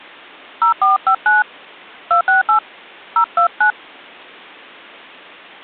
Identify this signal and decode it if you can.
DTMF, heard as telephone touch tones, dialled by hand, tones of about 130 ms. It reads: 0459 268 029